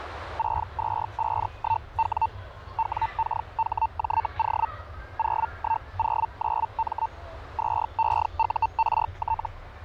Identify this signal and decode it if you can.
Hellschreiber (Feld-Hell, 122.5 baud), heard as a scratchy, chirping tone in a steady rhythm, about 900 Hz, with radio static and the noise of a park. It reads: 6251W WKHJO 0109M 2EURT